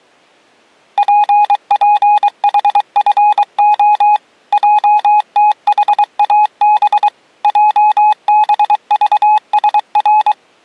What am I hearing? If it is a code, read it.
Morse code, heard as a keyed tone, machine-sent, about 23 wpm, 840 Hz. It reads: PPHFO JTHAB JBVSR